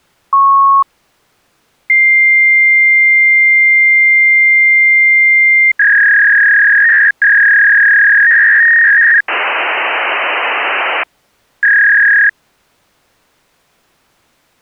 Fax machine handshake, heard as a beep, a long tone, a warble and hiss.